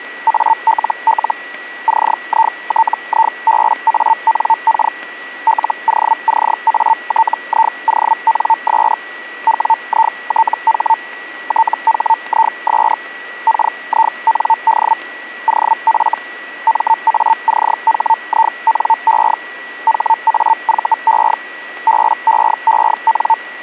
Hellschreiber (Feld-Hell, 122.5 baud), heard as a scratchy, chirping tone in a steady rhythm, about 900 Hz, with a steady whistle near 1940 Hz. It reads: ALL CITIBANK LOCATIONS WITH THIS KIND OF MACHINE HAVE BEEN